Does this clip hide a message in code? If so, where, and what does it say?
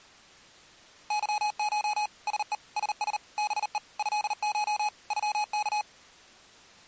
Yes: Morse code (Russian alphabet) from 1.0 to 5.9 s, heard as electronic beeps, machine-sent, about 39 wpm, 840 Hz. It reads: ЫШ СЕ СС БЕ ЭШ ЮК